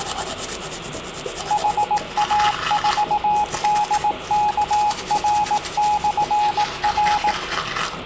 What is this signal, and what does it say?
Morse code, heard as a keyed tone, machine-sent, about 18 wpm, 840 Hz, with room echo and the noise of a restroom. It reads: HA4DKR/R